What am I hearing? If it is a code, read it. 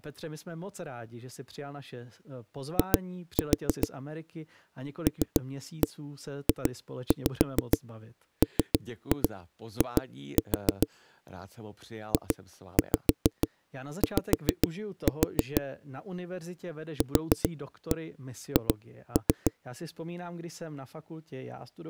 Tap code, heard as knocks on a wall, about 6 knocks a second, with speech in Czech. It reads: I LJMI JY QH